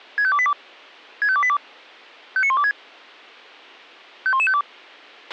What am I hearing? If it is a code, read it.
Five-tone selective call (ZVEI), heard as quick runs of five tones, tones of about 70 ms, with a squelch burst at the end. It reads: 65282 65282 59126 51152